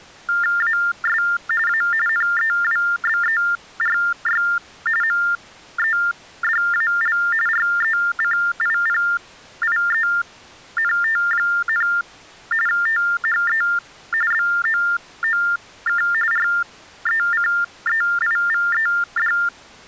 TTY/TDD text telephone tones (45.45 baud Baudot), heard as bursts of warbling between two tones, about 400 Hz shift, 1600 Hz centre. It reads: AS A NEWBERY MEDAL RECIPIENT, THE BOOK RECEIVED